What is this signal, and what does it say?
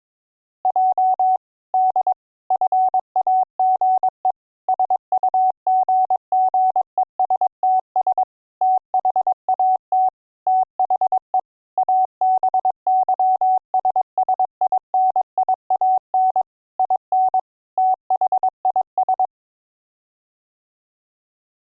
Morse code, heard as a keyed tone, machine-sent, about 22 wpm, 750 Hz. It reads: J D FAGE SUGGESTS THAT THE ABYSSINIAN IN THIS